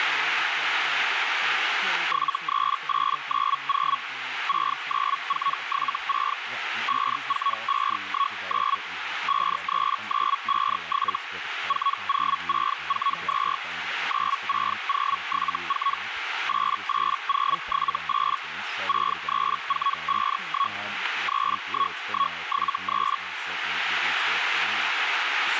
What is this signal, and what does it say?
Hellschreiber (Feld-Hell, 122.5 baud), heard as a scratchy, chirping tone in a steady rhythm, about 1110 Hz, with radio static, a narrow filter and speech in English. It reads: 73890 69476 54519 53957 40642 96074 88078 63451 31173